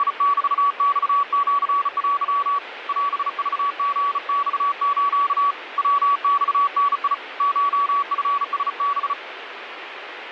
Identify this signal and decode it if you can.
Morse code (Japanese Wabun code), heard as a keyed tone, hand-sent with a bug key, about 35 wpm, 1140 Hz, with radio static. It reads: … オクリマス ヤマダ コチラハ